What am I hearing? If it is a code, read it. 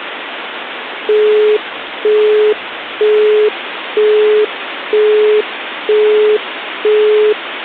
Telephone call progress tone (single-tone plan, as in Europe, Japan and elsewhere), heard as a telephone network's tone, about 420 Hz, 0.48 s on and 0.48 s off, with phone line noise. Busy tone.